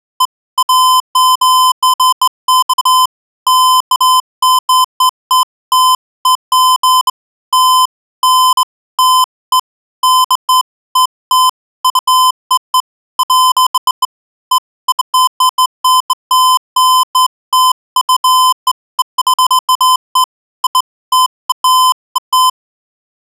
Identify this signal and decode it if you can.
Beeps of irregular length. There is no code.